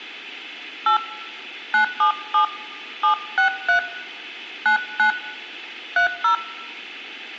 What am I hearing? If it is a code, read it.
DTMF, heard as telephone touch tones, dialled by hand, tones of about 110 ms, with room echo. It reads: 8 977 763 99 30